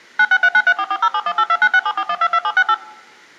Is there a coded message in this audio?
Yes: DTMF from 0.2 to 2.7 s, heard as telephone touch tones, dialled by machine, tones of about 60 ms. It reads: 9639344071829674122768